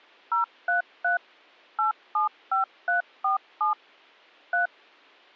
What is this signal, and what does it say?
DTMF, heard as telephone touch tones, dialled by machine, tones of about 130 ms. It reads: 033 875347 3